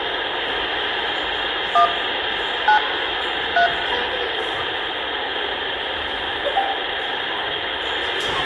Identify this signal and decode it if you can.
DTMF, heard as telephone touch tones, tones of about 100 ms, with phone line noise, room echo and the noise of a crowd indoors. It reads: 1 9 3